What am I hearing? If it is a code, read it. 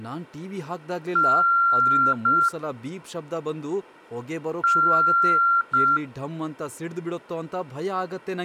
Beep code, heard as beeps, played twice, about 1380 Hz, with speech in Kannada. 1 long, 1 short. In IBM BIOS tables: system board problem.